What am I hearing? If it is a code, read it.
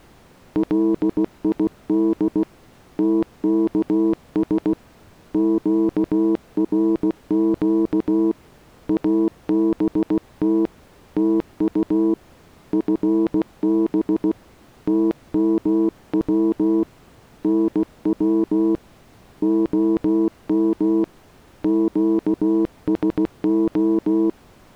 Morse code, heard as a keyed tone, hand-sent with a paddle, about 16 wpm, 330 Hz. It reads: LID TKS QRQ ABT TU FB TMW NW OM QSO